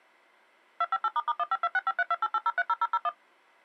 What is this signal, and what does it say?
DTMF, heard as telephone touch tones, dialled by machine, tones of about 40 ms. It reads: 258**152653288030001